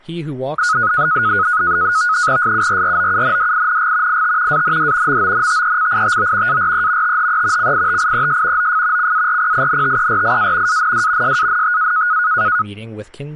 NAVTEX (SITOR-B), 100 baud, 170 Hz shift, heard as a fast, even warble, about 1360 Hz centre, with speech in English. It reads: SURROUNDING IT AND MONTECITO ARE THE CITIES OF CARPINTERIA AND SANTA